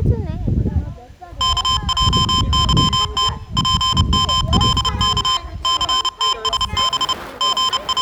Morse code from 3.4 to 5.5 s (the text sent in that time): PMLK